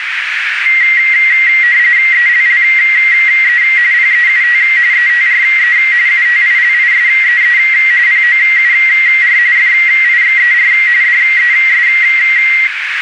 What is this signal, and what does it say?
RTTY (45.45 baud, 170 Hz shift), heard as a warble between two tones, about 2000 Hz centre, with radio static and a narrow filter. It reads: ELLE PEUT ETRE UTILISEE POUR FIXER DES